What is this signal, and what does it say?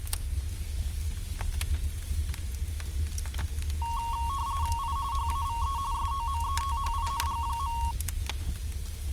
RTTY (45.45 baud, 170 Hz shift), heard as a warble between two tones, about 1010 Hz centre. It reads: I HAVE SOMETHING.